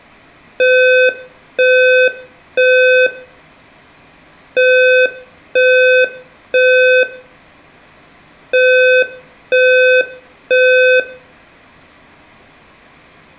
Alarm pattern, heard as an alarm's beeps, played three times, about 510 Hz, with room echo. Temporal three. Smoke or fire, evacuate.